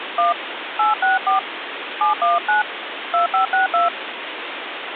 DTMF, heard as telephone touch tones, dialled by hand, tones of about 140 ms, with phone line noise. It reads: 1 864 719 2562